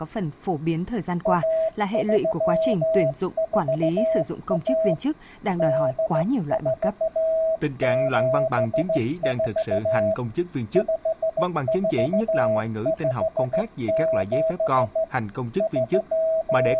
Morse code (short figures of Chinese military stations), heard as a keyed tone, hand-sent with a straight key, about 15 wpm, 650 Hz, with speech in Vietnamese. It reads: 1341 8474 5457 …